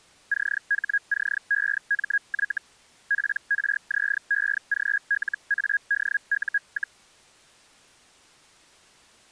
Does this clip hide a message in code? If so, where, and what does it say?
Yes: Hellschreiber (Feld-Hell, 122.5 baud) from 0.3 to 7.0 s, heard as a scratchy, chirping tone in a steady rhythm, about 1650 Hz. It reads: CHCEMY PRZEGLADU,